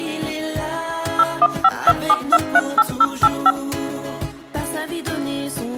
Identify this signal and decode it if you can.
DTMF, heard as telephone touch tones, dialled by machine, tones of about 50 ms. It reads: 01527238085